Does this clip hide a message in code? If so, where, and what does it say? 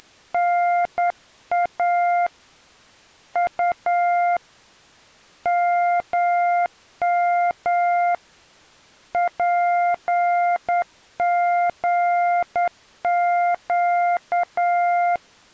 Yes: Morse code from 0.0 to 15.2 s, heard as a keyed tone, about 9 wpm, 700 Hz. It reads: … U MM PGQ